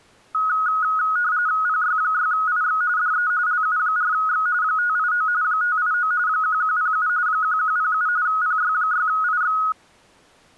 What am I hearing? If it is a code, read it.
RTTY (45.45 baud, 170 Hz shift), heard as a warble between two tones, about 1360 Hz centre. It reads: PY6IX DE LU4X 589 589 1107 1107 PY6IX